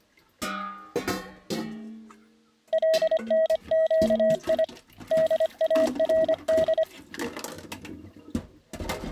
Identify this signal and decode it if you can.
Morse code (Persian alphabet), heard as a keyed tone, hand-sent with a paddle, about 25 wpm, 640 Hz, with kitchen noise. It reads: لنگی دارد